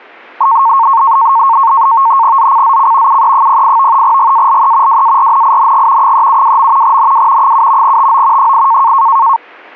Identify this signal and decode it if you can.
NAVTEX (SITOR-B), 100 baud, 170 Hz shift, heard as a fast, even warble, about 1000 Hz centre. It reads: ZCZC UE08 GALE WARNING 372. NW 7 TO 8